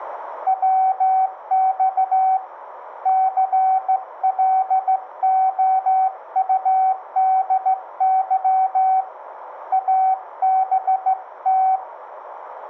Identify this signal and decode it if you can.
Morse code, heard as a keyed tone, hand-sent with a straight key, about 15 wpm, 760 Hz, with radio static. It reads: WX CLOUDY ABT